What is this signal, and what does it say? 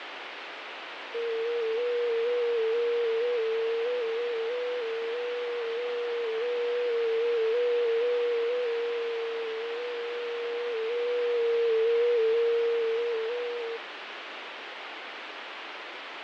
FT8 (one signal), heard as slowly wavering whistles, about 6.25 baud, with radio static and fading.